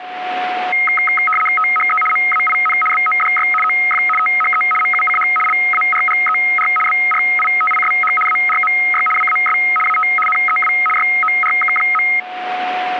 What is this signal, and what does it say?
RTTY (75 baud, 850 Hz shift), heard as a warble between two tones, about 1700 Hz centre, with a steady whistle near 730 Hz. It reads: THE MAIN BODY OF THE MUCH LARGER BRITISH ARMY WAS AT NEW YORK.